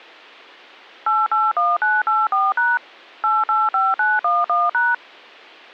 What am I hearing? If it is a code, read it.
DTMF, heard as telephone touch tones, dialled by machine, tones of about 200 ms. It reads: 881984# 885911#